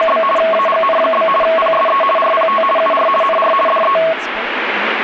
RTTY (50 baud, 450 Hz shift), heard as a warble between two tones, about 880 Hz centre, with radio static and speech in English. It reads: … AGN? PSE RPT UR NR DE